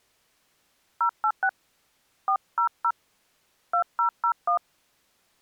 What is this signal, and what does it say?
DTMF, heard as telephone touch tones, dialled by hand, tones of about 80 ms. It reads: 086 400 2001